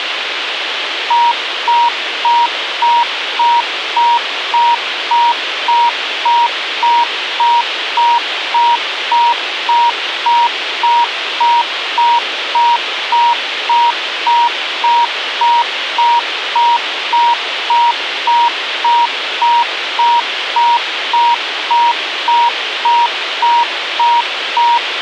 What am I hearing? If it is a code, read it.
Evenly repeated beeps, with radio hiss. There is no code.